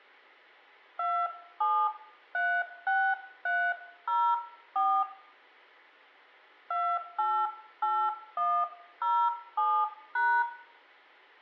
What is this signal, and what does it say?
DTMF, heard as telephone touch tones, dialled by hand, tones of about 270 ms, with room echo. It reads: 2736304 288107#